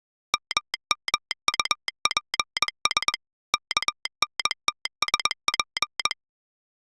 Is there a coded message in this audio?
Yes: Morse code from 0.3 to 6.2 s, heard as a telegraph sounder, machine-sent, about 21 wpm. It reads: MMUPS KNTSP